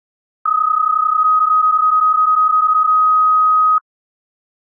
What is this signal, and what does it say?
PSK31 (31.25 baud), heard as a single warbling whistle, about 1260 Hz.